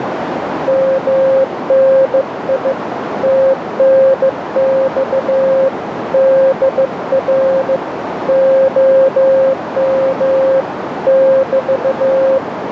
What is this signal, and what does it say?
Morse code, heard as a keyed tone, hand-sent with a bug key, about 15 wpm, 530 Hz, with radio static and a narrow filter. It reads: MNI TNX DR OM <BT>